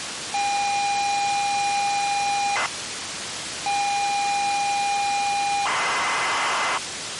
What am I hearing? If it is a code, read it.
ZX Spectrum tape loading, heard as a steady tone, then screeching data, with tape hiss.